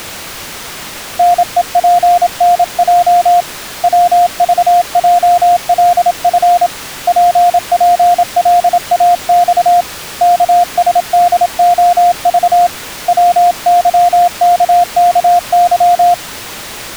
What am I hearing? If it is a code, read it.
Morse code, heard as a keyed tone, hand-sent with a paddle, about 27 wpm, 700 Hz. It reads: NEPNJ WVJLF PPLAX KSDOV WYKKY